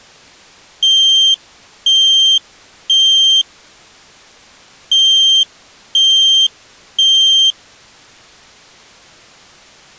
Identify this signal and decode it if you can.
Alarm pattern, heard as an alarm's beeps, played twice, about 3150 Hz. Temporal three. Smoke or fire, evacuate.